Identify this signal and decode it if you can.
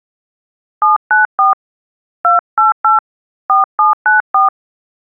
DTMF, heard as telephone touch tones, dialled by hand, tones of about 140 ms. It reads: 794 288 4794